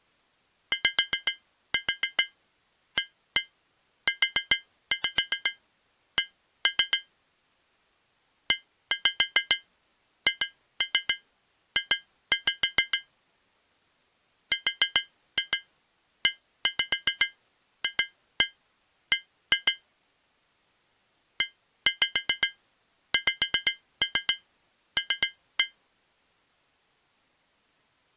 Tap code, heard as taps on glass, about 7 knocks a second. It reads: YAUC EHJ REFB EXL